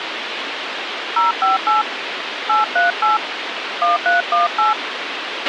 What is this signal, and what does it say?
DTMF, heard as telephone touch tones, dialled by hand, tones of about 150 ms, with radio hiss and a squelch burst at the end. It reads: 058 838 1318